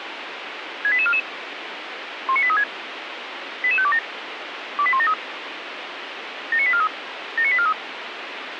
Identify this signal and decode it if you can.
Five-tone selective call (ZVEI), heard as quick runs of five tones, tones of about 70 ms, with radio hiss. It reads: 68844 19836 88527 28173 79843 79843